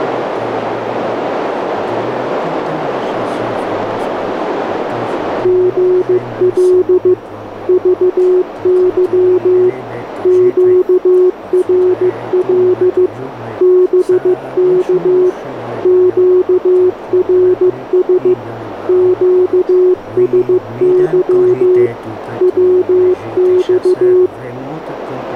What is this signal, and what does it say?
Morse code, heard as a keyed tone, machine-sent, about 15 wpm, 360 Hz, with radio static and a narrow filter. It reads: GL VY QRL BK QRS QSY WX